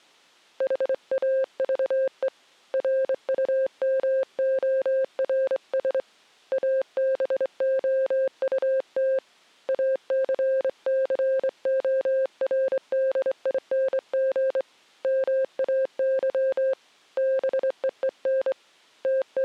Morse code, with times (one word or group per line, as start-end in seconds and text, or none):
0.6-2.3 HAVE
2.7-6.0 RUMORS
6.5-9.2 ABOUT
9.7-14.6 ACCORDING
15.0-16.7 MAY
17.2-18.5 BEEN
19.0-19.4 …